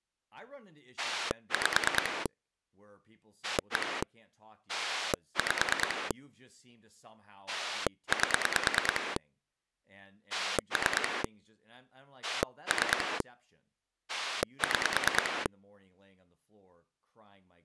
Pulse dialling, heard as a rotary dial, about 9 pulses a second, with speech in English. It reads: 5 1 5 8 3 3 6